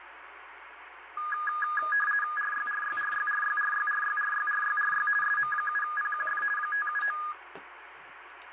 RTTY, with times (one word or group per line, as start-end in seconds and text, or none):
2.4-5.1 RYRYRYRYRYRYRYRYRY
5.2-6.4 SM7PQF
6.6-7.2 579